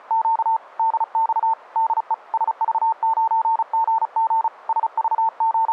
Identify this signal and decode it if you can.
Morse code, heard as a keyed tone, hand-sent with a paddle, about 35 wpm, 900 Hz. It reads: … DX DE SV9GG …